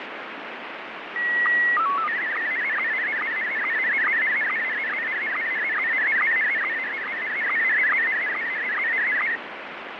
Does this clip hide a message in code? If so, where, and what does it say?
Yes: SSTV (slow-scan television), Scottie S1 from 1.2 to 9.4 s, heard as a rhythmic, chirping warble, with heavy radio static and fading.